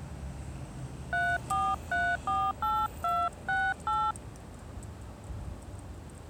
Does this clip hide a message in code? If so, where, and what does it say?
Yes: DTMF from 1.1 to 4.1 s, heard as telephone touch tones, dialled by hand, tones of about 240 ms, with street noise. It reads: 34348268